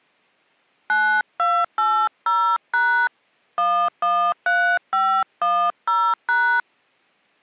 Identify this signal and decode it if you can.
DTMF, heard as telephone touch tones, dialled by hand, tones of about 290 ms. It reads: 9280# 113510#